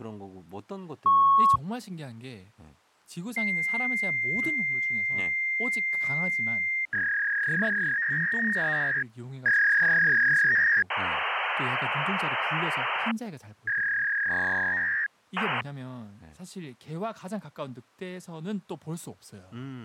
Fax machine handshake, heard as a beep, a long tone, a warble and hiss, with speech in Korean.